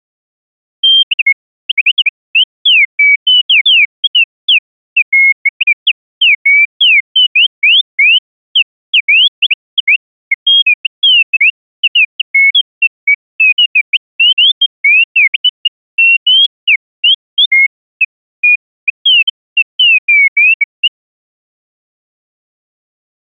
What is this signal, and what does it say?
Bird-like chirps. There is no code.